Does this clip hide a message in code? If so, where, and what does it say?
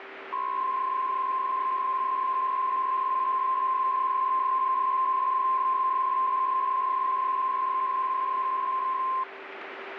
Yes: PSK63 (62.5 baud) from 0.3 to 9.2 s, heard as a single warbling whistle, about 1050 Hz, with radio static and a steady whistle near 390 Hz.